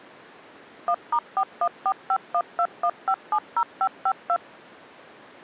DTMF, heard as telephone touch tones, dialled by machine, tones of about 60 ms. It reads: 1*4145121570552